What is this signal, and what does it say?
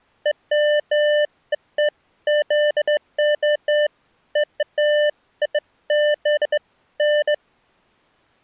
Beeps of irregular length. There is no code.